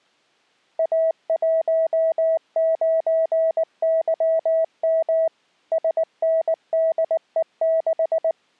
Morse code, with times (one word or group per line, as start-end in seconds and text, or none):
0.8-5.3 A19YM
5.7-8.3 SNDE6